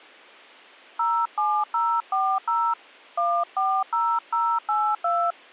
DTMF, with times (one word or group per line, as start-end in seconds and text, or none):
1.0-2.7 07040
3.2-5.3 140082